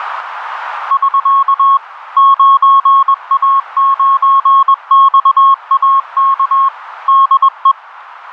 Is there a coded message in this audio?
Yes: Morse code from 0.8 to 7.8 s, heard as a keyed tone, machine-sent, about 21 wpm, 1090 Hz, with radio static. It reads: <SK> 9A9XAK DE